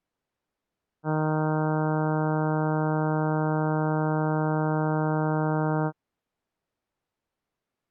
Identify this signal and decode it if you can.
Ship horn signal, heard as a ship's horn, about 160 Hz. 1 long. At sea: a vessel nearing a blind bend, or under power and making way in fog.